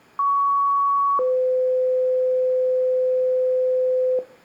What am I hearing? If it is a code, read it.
Two-tone page, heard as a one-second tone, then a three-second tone, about 1120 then 510 Hz, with room echo.